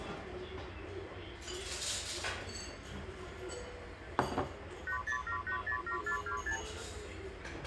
Multi-frequency trunk signalling (R2, with the far end's replies), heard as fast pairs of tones, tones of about 100 ms, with phone line noise and the noise of a restaurant. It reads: 807807426